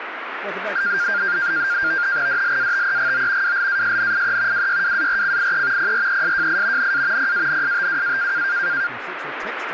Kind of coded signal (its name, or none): NAVTEX (SITOR-B)